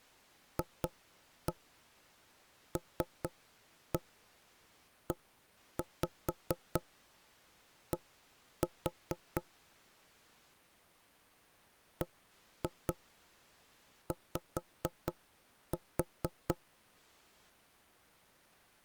Tap code, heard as knocks on wood, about 4 knocks a second. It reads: FLED BY